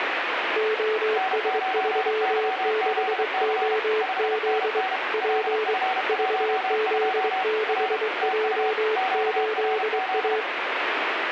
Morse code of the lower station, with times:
0.6-4.8 OS36OZ
5.1-5.7 P
6.1-10.4 VZ6J8A

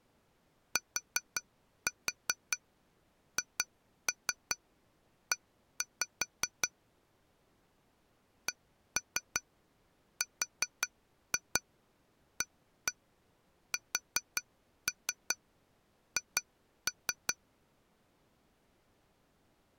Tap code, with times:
0.8-6.7 THE
8.5-17.3 CRASH

